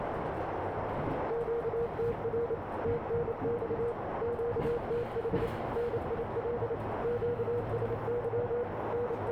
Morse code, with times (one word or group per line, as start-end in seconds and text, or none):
1.3-2.5 QTR
2.8-3.9 TNX
4.2-5.5 QTH
5.8-6.7 NIL
7.0-8.6 QSY
8.9-9.3 …